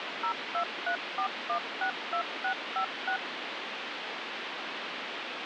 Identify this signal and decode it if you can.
DTMF, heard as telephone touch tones, dialled by machine, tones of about 90 ms, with phone line noise. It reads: 0234162656